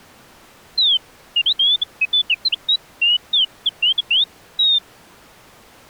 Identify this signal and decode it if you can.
Bird-like chirps. There is no code.